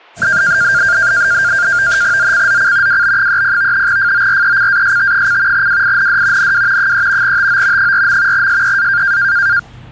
NAVTEX (SITOR-B), 100 baud, 170 Hz shift, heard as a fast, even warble, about 1500 Hz centre, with the noise of a restroom. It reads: ZCZC WB30 FORECAST: WIND NW 3 TO 4. SEA